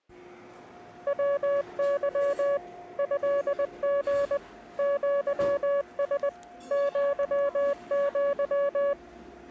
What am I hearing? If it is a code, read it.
Morse code (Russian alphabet), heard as a keyed tone, machine-sent, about 20 wpm, 560 Hz, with the noise of a cafe. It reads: ВЫ ЭГ ЪС ЪЪ